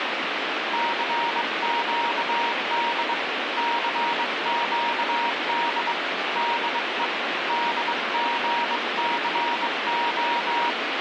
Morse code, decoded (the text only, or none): CQD CQD DE DGCO